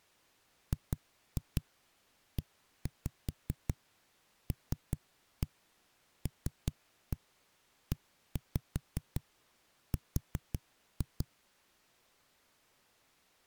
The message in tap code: GELLER

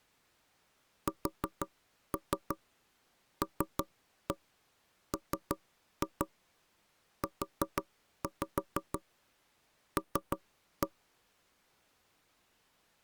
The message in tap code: SLMUL

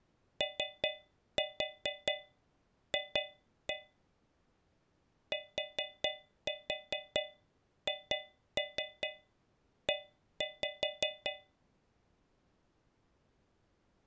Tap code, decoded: OF THE

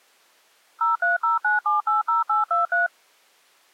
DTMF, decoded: 0309780823

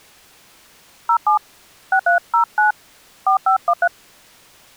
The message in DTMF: 07 6309 4513

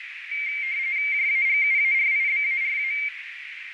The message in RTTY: JAGUARIBARA

